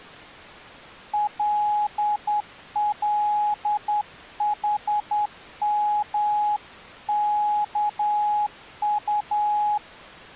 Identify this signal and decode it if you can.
Morse code (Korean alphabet), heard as a keyed tone, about 10 wpm, 840 Hz. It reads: 꿈이